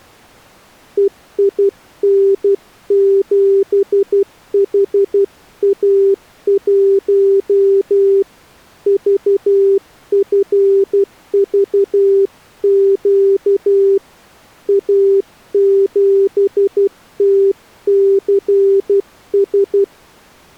Morse code, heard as a keyed tone, hand-sent with a paddle, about 12 wpm, 390 Hz. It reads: EIN7HA1 VFVQ A7TCS